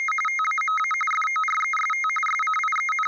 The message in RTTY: … TAMA FOREST …

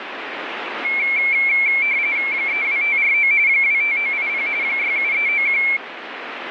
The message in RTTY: 32549 25980 67391

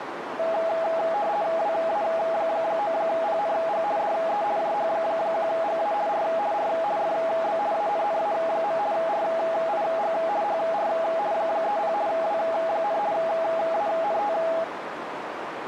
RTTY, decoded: WA9PNG DE JH1GA R R FB ANNA. RIG HR 30 W, ANT

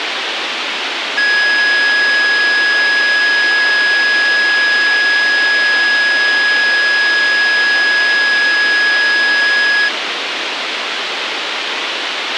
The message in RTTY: none

